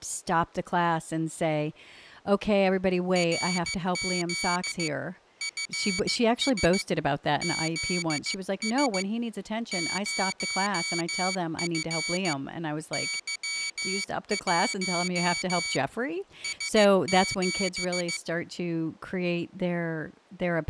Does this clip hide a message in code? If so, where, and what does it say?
Yes: Morse code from 3.1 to 18.2 s, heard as a high beeper, hand-sent with a paddle, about 15 wpm, 2250 Hz, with speech in English. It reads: RZ FS ZS 0F Y1 S7